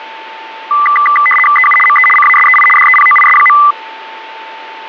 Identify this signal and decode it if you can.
RTTY (75 baud, 850 Hz shift), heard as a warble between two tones, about 1600 Hz centre, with a steady whistle near 890 Hz. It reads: EU ME CASEI DEPOIS.